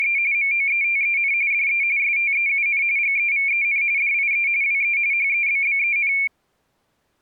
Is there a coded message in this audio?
Yes: RTTY (45.45 baud, 170 Hz shift) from 0.0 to 6.3 s, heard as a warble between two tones, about 2300 Hz centre. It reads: … MOETEN DE STEUN GEVEN DIE WE HEBBEN